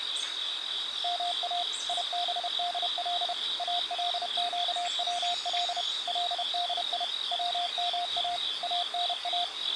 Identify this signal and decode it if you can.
Morse code (Arabic alphabet), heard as a keyed tone, machine-sent, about 31 wpm, 700 Hz, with the noise of a park. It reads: ما يبدل القول لدي وما انا